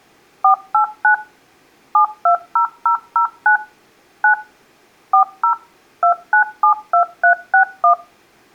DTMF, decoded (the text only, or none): 489 720009 9 40 2972361